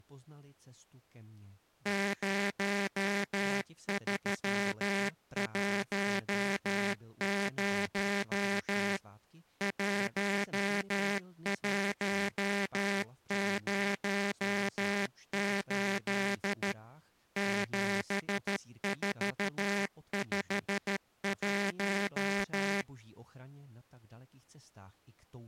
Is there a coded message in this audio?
Yes: Morse code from 1.8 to 22.9 s, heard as a buzzer, machine-sent, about 13 wpm. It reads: 0310 1108 7451